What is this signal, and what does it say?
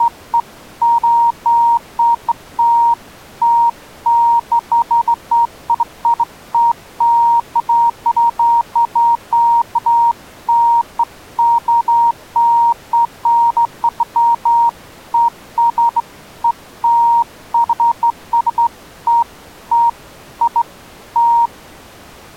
Beeps of irregular length. There is no code.